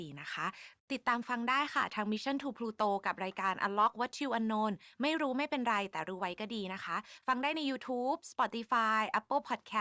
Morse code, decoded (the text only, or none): none